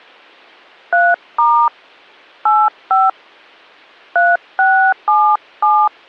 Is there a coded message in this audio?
Yes: DTMF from 0.9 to 5.9 s, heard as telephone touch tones, dialled by hand, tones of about 290 ms. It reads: 3* 85 3677